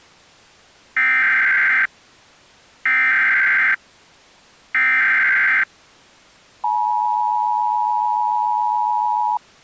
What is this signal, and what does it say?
Emergency Alert System (SAME) tones (header bursts, then the 853 and 960 Hz attention tone), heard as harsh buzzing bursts, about 520.83 baud.